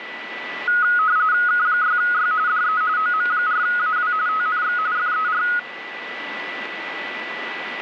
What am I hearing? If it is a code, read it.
RTTY (45.45 baud, 170 Hz shift), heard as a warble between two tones, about 1360 Hz centre, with radio static and a steady whistle near 1970 Hz. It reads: K6Y DE OM4AW TNX FER